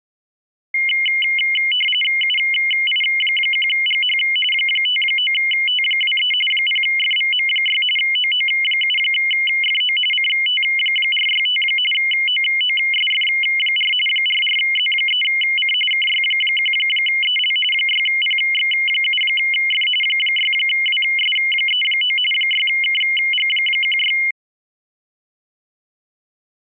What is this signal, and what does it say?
RTTY (45.45 baud, 850 Hz shift), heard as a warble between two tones, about 2550 Hz centre. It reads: UI1GH 59T23 0FVM6 OO7FO CT465 OOSF4 44Z3C KY1EL 6PX7F 6WS39 6KG16